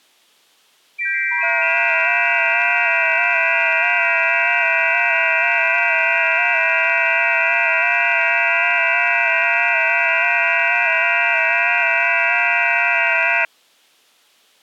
FT8 (several signals at once), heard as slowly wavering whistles, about 6.25 baud.